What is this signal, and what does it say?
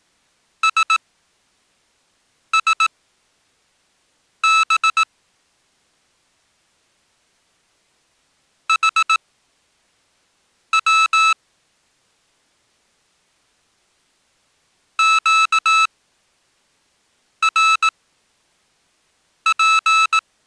Morse code, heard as electronic beeps, machine-sent, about 18 wpm, spaced as for 5 wpm, 1310 Hz. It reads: SSB HW QRP